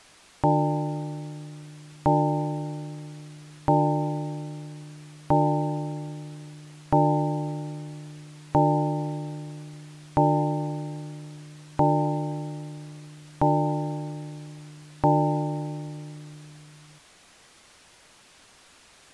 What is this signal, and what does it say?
Clock strike, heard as a bell. 10. Ten o'clock.